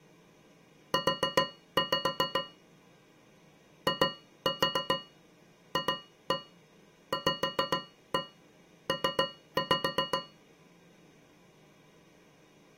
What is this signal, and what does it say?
Tap code, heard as taps on a metal pipe, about 7 knocks a second. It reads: U IFVP